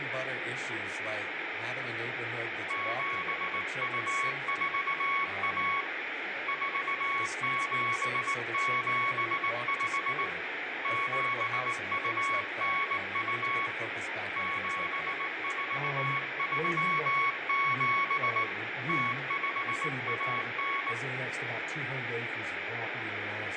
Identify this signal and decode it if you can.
Morse code (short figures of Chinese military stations), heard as a keyed tone, hand-sent with a straight key, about 19 wpm, 1110 Hz, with radio static and room echo. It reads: 7241 4775 7292 7437 0519